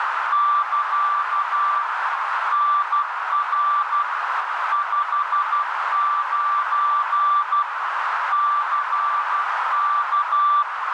Morse code, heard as a keyed tone, machine-sent, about 12 wpm, 1170 Hz, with heavy radio static and a narrow filter. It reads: <KA> NR 59 CK